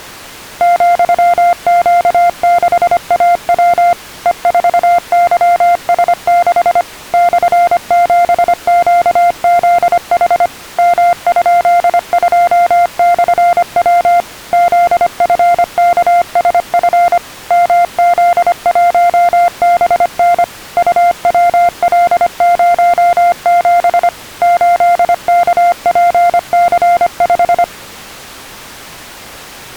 Morse code, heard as a keyed tone, machine-sent, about 25 wpm, 700 Hz. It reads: ,Q6AW E4YS6 /7QZH M?2/W ZFKSF MZ1BN UWL07 8KPC5